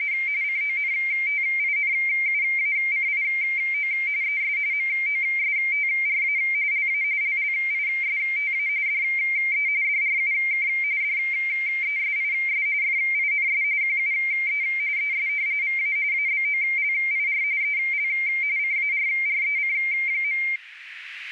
RTTY (45.45 baud, 170 Hz shift), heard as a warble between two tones, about 2200 Hz centre, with radio static and a narrow filter. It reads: … CONTINUACIO ES MOSTRA LA LLISTA DE DRUK DESIS FINS QUE ES VA ABOLIR EL CARREC.